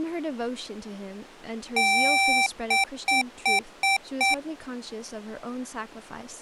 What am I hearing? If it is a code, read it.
Beep code, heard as beeps from a small speaker, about 780 Hz, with speech in English. 1 long, 5 short.